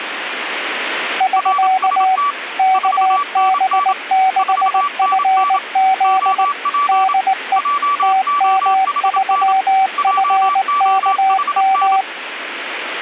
Morse code, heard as two keyed tones. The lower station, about 19 wpm, 760 Hz: <SK> KB6FZ DE TM3FKM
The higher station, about 27 wpm, 1150 Hz: RST 4NN 4NN OP JOHN JOHN